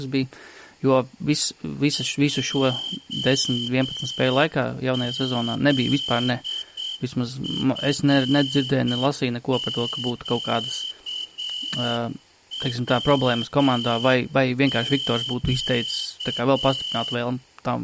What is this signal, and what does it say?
Morse code, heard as a whistle, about 7 wpm, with room echo and speech in Latvian. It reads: JZFQWQ